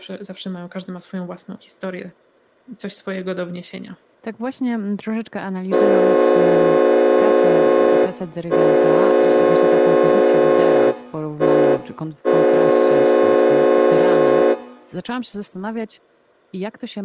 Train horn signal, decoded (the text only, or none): 2 long, 1 short, 1 long